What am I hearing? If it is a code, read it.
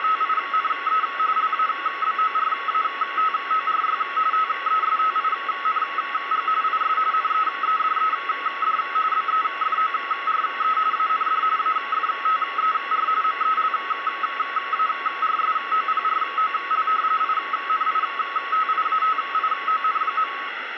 RTTY (45.45 baud, 170 Hz shift), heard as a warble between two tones, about 1200 Hz centre, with radio static. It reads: … LABORATORY TESTING IS NEEDED BEFORE AND AFTER MELARSOPROL INITIATION.